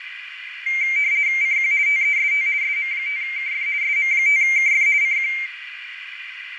RTTY (50 baud, 170 Hz shift), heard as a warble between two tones, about 2200 Hz centre, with radio static, fading and a narrow filter. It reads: CQ TEST SM5KF SM5KF CQ